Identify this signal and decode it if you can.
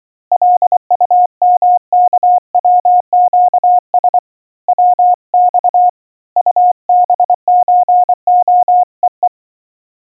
Morse code (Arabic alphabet), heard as a keyed tone, hand-sent with a paddle, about 24 wpm, 720 Hz. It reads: لطمكوقس وص طبزخءء